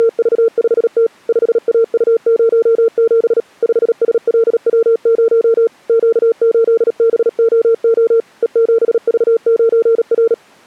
Morse code, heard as a keyed tone, machine-sent, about 37 wpm, 460 Hz. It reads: … 5AU07 5SLW0 Q8BOO E7V9R